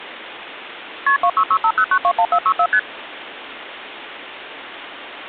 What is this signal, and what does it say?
Multi-frequency trunk signalling (R1, as on North American trunks), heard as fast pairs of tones, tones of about 70 ms, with phone line noise. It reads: KP 26650921464 ST